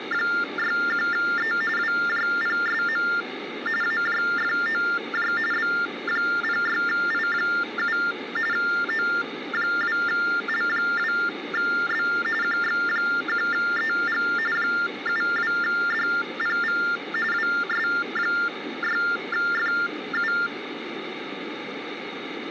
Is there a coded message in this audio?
Yes: TTY/TDD text telephone tones (45.45 baud Baudot) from 0.0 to 20.5 s, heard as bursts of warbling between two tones, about 400 Hz shift, 1600 Hz centre, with phone line noise. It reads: … WJPSM AJFOJ B06I7 O2L2B QX1EG 72DPV WS6FU